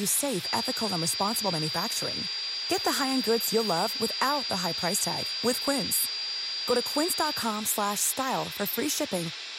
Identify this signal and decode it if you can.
A steady tone, with radio hiss, room echo and speech in English. There is no code.